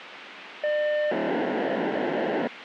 POCSAG pager data (1200 baud), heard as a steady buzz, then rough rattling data, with radio hiss.